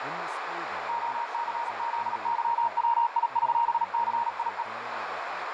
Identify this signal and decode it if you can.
Morse code (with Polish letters), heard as a keyed tone, machine-sent, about 37 wpm, 940 Hz, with radio static, a narrow filter and speech in English. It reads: OCZYWIŚCIE